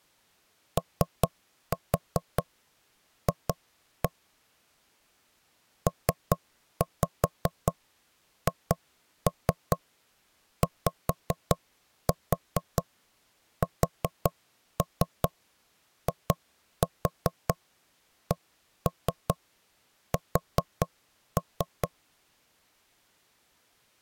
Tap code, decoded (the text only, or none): OF PHYSICS